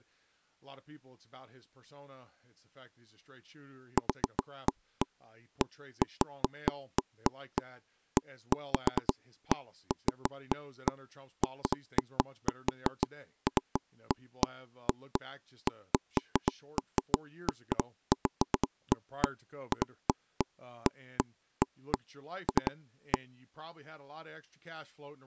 Irregular taps on a table, with speech in English. There is no code.